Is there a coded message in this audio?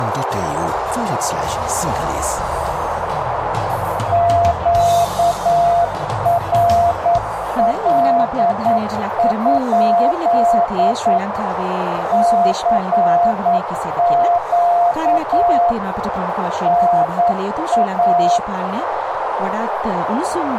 Yes: Morse code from 4.1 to 18.4 s, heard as a keyed tone, machine-sent, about 9 wpm, 690 Hz, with radio static and a narrow filter. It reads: QRL? CQ NA